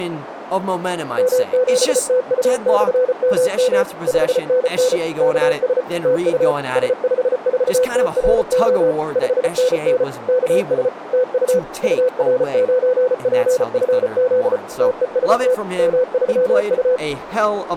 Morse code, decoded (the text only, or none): M7TU/MM 5NN KS TU S54TRO 5NN KS TU UR9PFZ TEST M3U